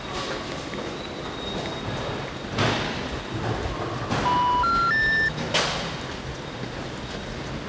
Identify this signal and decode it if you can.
Telephone call progress tone (North American plan), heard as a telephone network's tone, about 980, 1370, 1800 Hz, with the noise of a subway station. Special information tone.